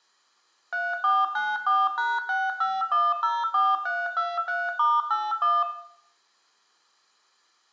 DTMF, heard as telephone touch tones, dialled by machine, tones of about 210 ms, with room echo. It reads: 3494#65104323*81